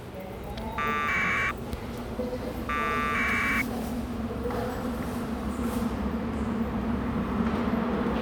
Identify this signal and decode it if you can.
Packet radio (AX.25, as in APRS), 1200 baud, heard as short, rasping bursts, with a squelch burst at the end and the noise of a subway station.